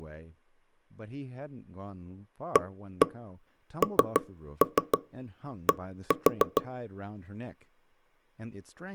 Tap code, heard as knocks on wood, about 6 knocks a second, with speech in English. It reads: AND